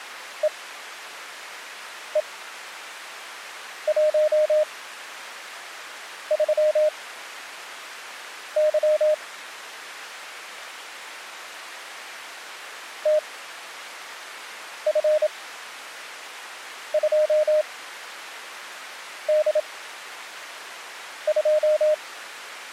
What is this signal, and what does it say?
Morse code, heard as a keyed tone, machine-sent, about 27 wpm, spaced as for 5 wpm, 610 Hz. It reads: EE13Y TF2D2